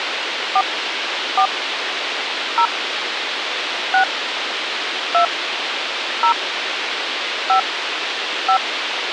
DTMF, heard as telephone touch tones, dialled by hand, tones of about 80 ms, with radio hiss. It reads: 4 4 0 6 2 0 5 5